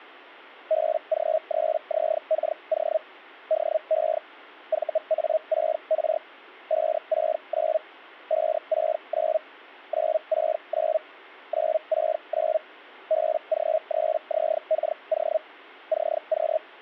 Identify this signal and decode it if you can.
Hellschreiber (Feld-Hell, 122.5 baud), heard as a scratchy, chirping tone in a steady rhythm, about 630 Hz. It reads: BG3ZKO DE VA6R 569 569 969 969 BG3ZKO CQ